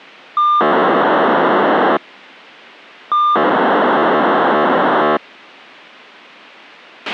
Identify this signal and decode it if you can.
POCSAG pager data (2400 baud), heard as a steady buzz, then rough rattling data, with a squelch burst at the end.